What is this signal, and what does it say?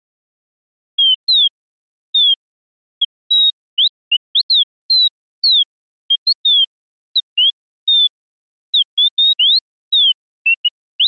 Bird-like chirps. There is no code.